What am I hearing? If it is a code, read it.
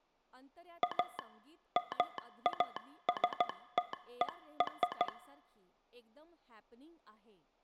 Morse code (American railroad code), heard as a telegraph sounder, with speech in Marathi. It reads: A MASTER